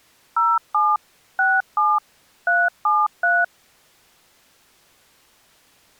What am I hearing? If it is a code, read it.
DTMF, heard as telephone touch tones, dialled by machine, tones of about 220 ms. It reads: 07 67 373